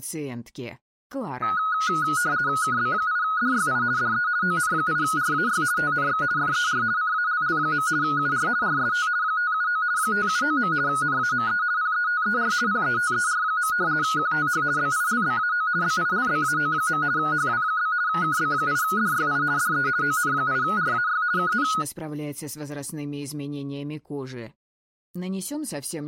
RTTY (50 baud, 170 Hz shift), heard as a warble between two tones, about 1360 Hz centre. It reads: KB8DYI DE ON8RAY TNX FER CALL. UR RST 579 579. NAME PETER PETER. QTH BILBAO BILBAO. HW? KB8DYI DE ON8RAY KN